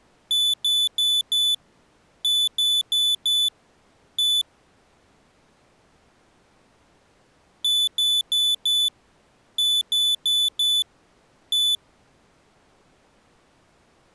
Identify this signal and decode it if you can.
Beep code, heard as a piezo beeper, played twice, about 3500 Hz. 4-4-1. In Phoenix BIOS tables: serial port failure.